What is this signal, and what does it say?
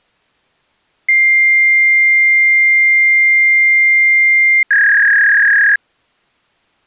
Fax machine handshake, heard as a long tone and a warble.